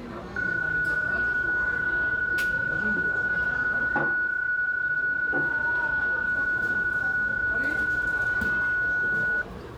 PSK31 (31.25 baud), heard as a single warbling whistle, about 1470 Hz, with the noise of a cafe.